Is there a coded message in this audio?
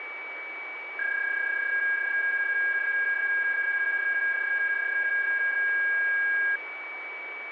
Yes: PSK31 (31.25 baud) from 1.0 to 6.6 s, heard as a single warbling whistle, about 1650 Hz, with radio static and a steady whistle near 2280 Hz.